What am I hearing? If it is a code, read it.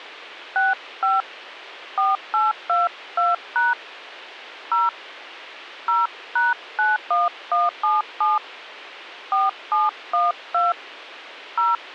DTMF, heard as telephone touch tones, dialled by hand, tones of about 180 ms. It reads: 65 4822# 0 0#91177 4712 0